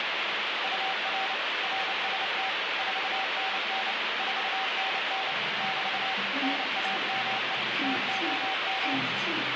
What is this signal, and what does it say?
Morse code, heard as a keyed tone, machine-sent, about 29 wpm, 770 Hz, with heavy radio static and the noise inside a lift. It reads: UR RST 4NN 4NN <BT> NAME TOM